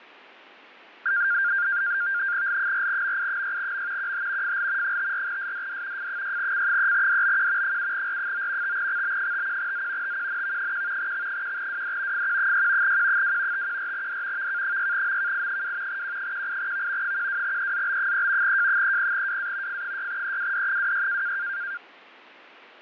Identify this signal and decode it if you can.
NAVTEX (SITOR-B), 100 baud, 170 Hz shift, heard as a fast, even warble, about 1500 Hz centre, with fading. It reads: L4MI6M QH FL 54SDD F6C3DBQ 7R9 5XB51Z TQNV1 X1WD FQ6 Q2 514D VK6MKI2 Q18V 12EZB3 J30WA F6EWD26